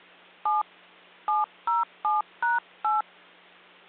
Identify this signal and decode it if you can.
DTMF, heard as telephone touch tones, dialled by hand, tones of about 160 ms, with hum. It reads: 7 707#8